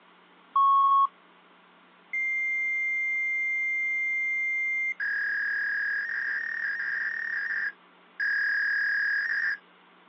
Fax machine handshake, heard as a beep, a long tone and a warble.